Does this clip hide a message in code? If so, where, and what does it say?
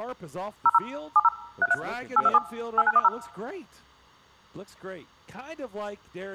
Yes: DTMF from 0.7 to 3.1 s, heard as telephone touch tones, dialled by machine, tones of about 40 ms. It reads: 00 70 33 827 8910